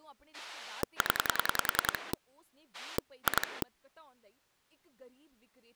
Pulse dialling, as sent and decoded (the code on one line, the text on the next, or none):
10 / 2
0 2